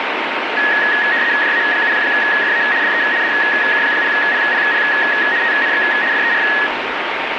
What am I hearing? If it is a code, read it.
RTTY (75 baud, 170 Hz shift), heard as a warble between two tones, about 1800 Hz centre, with radio static. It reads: JA7FA DE DK0PPP TNX FER